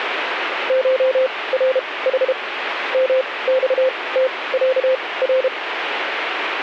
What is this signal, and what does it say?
Morse code (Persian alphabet), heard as a keyed tone, machine-sent, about 32 wpm, spaced as for 21 wpm, 520 Hz, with radio static. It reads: شرح مختصر